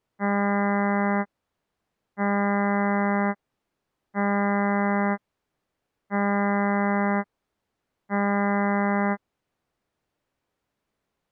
Ship horn signal, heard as a ship's horn, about 200 Hz. 5 short. At sea: I doubt that you are doing enough to avoid a collision.